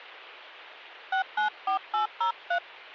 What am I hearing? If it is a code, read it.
DTMF, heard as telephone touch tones, dialled by hand, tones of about 110 ms. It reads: 694803